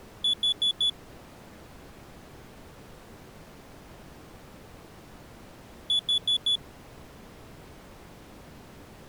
Alarm pattern, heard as an alarm's beeps, played twice, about 3450 Hz. Temporal four. Carbon monoxide.